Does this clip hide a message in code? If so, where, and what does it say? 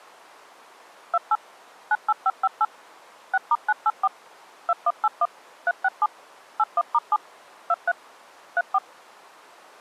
Yes: DTMF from 1.1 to 8.8 s, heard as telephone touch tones, dialled by machine, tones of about 40 ms. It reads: 28 98558 6*984 2181 367 81*7 23 34